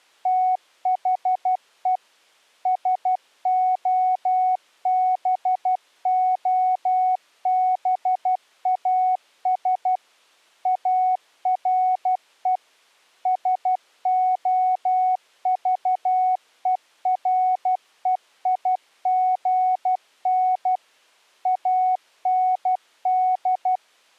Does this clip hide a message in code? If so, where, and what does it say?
Yes: Morse code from 0.2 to 23.8 s, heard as a keyed tone, machine-sent, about 12 wpm, 740 Hz. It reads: THE SOBOBAS ARE SOVEREIGN AND